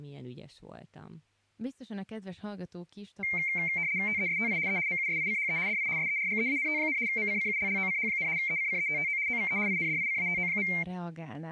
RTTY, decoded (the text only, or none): TESTI E MUSICHE DI SERGEANT, MCCULLOCH, ECCETTO OVE INDICATO.